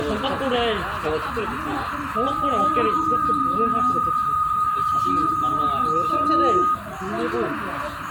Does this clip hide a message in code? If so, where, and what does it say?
Yes: PSK63 (62.5 baud) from 2.2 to 6.7 s, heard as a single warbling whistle, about 1240 Hz, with radio static, a narrow filter, room echo and the noise of a park.